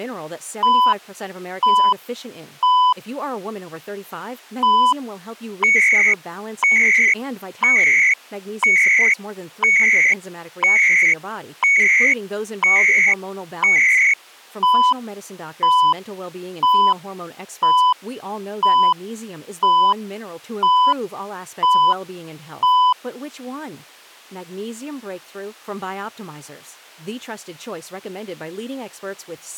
Radio time signal (CHU, Canada), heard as beeps and data bursts, one a second, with speech in English.